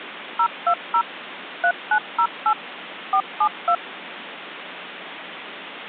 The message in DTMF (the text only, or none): 020 3908 472